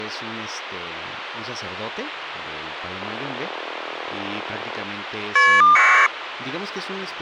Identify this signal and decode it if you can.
Caller ID data burst, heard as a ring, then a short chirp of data, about 1200 baud, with phone line noise and speech in Spanish.